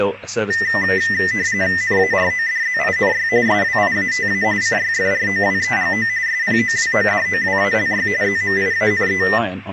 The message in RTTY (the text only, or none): NARODZINY SWIATA CYFROWEGO SPOWODOWALY ZMIANE